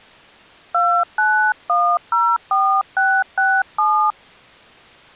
DTMF, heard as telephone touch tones, dialled by hand, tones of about 290 ms. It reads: 29104667